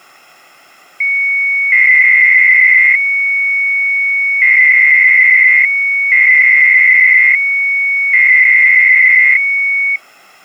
300-baud modem data (Bell 103 tones), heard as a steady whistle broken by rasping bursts, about 300 baud, 200 Hz shift.